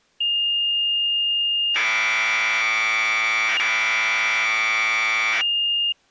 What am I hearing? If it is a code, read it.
Commodore tape loading (standard loader), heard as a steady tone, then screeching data.